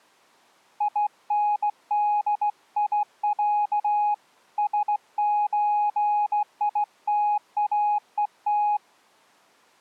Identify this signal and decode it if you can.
Morse code (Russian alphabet), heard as a keyed tone, hand-sent with a straight key, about 16 wpm, 830 Hz. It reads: ИНДИЯ СЧИТАЕТ